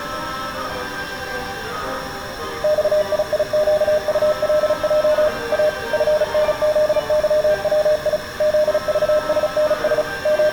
Morse code, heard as a keyed tone, machine-sent, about 35 wpm, 610 Hz, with room echo. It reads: XIIQULJ A FNZYWI ZVSNS …